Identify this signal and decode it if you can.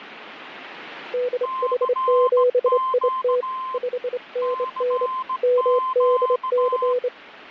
Morse code, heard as two keyed tones, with radio static. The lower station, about 26 wpm, 500 Hz: DH7IT 5NN MDC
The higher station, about 17 wpm, 1040 Hz: CQ CQ